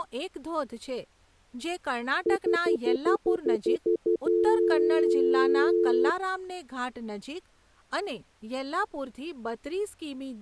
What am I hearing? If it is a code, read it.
Telephone call progress tone (North American plan), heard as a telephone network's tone, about 350, 440 Hz, 0.1 s on and 0.1 s off, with speech in Gujarati. Stutter dial tone.